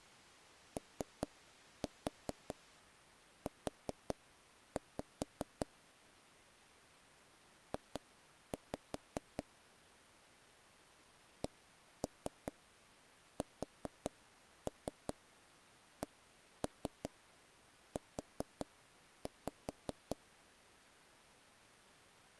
Tap code, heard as knocks on wood, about 5 knocks a second. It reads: OU J CSCU